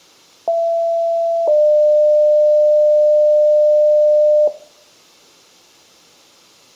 Two-tone page, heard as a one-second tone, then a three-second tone, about 670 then 600 Hz, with room echo.